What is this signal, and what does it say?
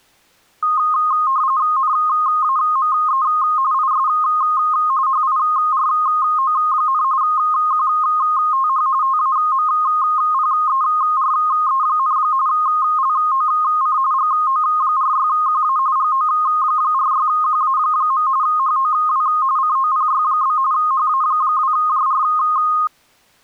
RTTY (45.45 baud, 170 Hz shift), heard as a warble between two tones, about 1150 Hz centre. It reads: NAME IS HIRO, QTH TAMPERE, LOC GO46QA GO46QA. HOW COPY? HA2JR